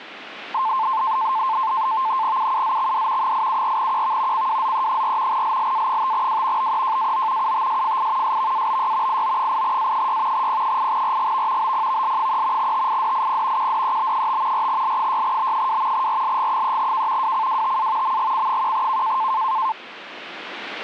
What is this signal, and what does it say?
NAVTEX (SITOR-B), 100 baud, 170 Hz shift, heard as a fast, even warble, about 970 Hz centre. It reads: UUZXD 874QV CWZE4 LLA5W BEJAO UTSFI SVABY IO8A6 P8RGV BPVL3 TIDIP QDEB5 4L6B2 RLG3K WCWTA MGC1K